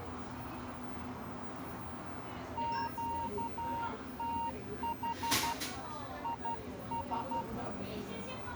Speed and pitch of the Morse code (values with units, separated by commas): 12 wpm, 930 Hz